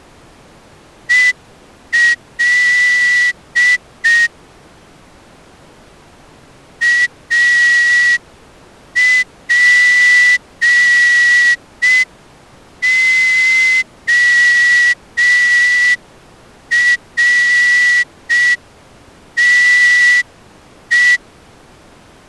Morse code, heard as a whistle, hand-sent with a straight key, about 5 wpm. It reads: EL APORTE